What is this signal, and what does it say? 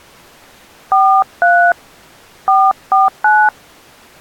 DTMF, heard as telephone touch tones, dialled by hand, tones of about 240 ms. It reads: 43 449